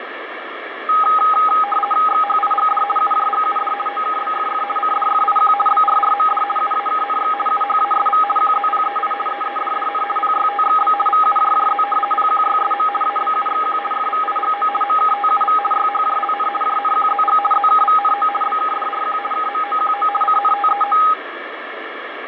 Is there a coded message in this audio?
Yes: RTTY (50 baud, 450 Hz shift) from 0.9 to 21.1 s, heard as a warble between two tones, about 1040 Hz centre, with radio static and fading. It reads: XHIGD UJGUD OKBFF CDFIQ BRRMD UAKNX UHASV QZPEI EEDDN PYTXB VUJJZ PQYSM ABUXQ FVIGO MKTUV YHJLN JNQZG ZKVNO BKDRQ KMOQO CNTEO